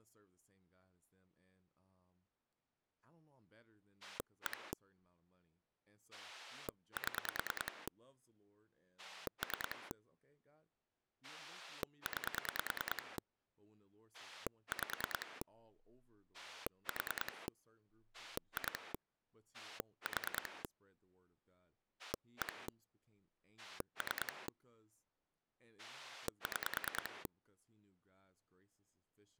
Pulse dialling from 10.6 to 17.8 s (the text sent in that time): 9 5 4